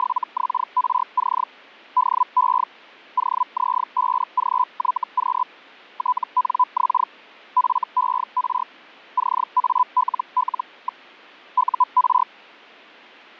Hellschreiber (Feld-Hell, 122.5 baud), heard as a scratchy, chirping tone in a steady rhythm, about 1000 Hz. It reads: … DE OZ5GYQ TNX FER CALL. UR